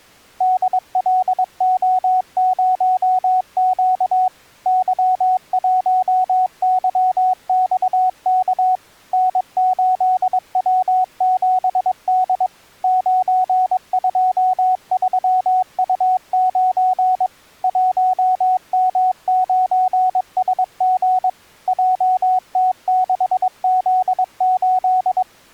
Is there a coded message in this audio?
Yes: Morse code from 0.3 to 25.3 s, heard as a keyed tone, machine-sent, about 22 wpm, 740 Hz. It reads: DLO0Q Y1YXK N8W7D 923U9 1M9SG JT6Z8